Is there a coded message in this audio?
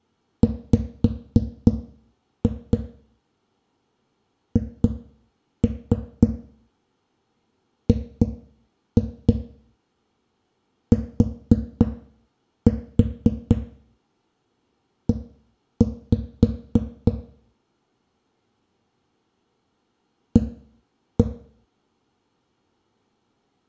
Yes: tap code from 0.4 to 21.3 s, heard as knocks on a wall, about 3 knocks a second, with room echo. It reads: WHGTE A